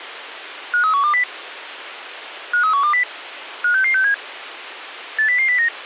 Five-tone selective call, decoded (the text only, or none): 53120 53120 56667 80009